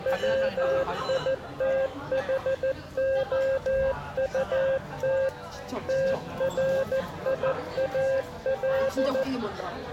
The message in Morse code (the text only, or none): WITHOUT TRIAL